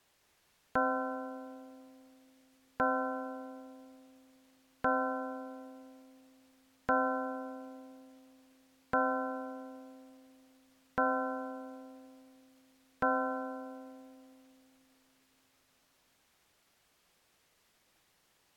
Clock strike, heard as a bell. 7. Seven o'clock.